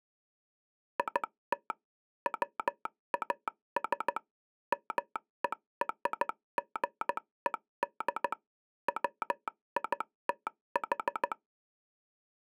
Morse code (American railroad code), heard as a telegraph sounder, machine-sent. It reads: IT WAS MERGED WITH